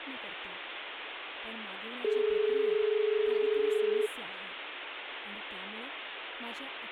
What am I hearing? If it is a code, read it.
Telephone call progress tone (as in Australia), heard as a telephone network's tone, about 430 Hz, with phone line noise and speech in Marathi. Dial tone.